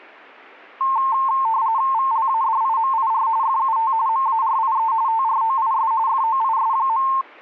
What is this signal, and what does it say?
RTTY (45.45 baud, 170 Hz shift), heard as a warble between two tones, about 980 Hz centre. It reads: VLADIMIR FUT MARIE TROIS FOIS.